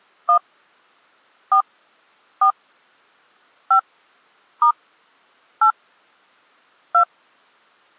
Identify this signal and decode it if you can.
DTMF, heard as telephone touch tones, dialled by hand, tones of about 90 ms. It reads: 1 4 4 5 * 8 2